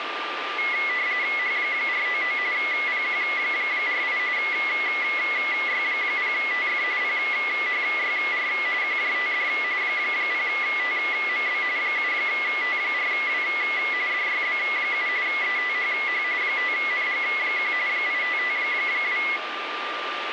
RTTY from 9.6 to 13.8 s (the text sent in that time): 0TMB 7T4W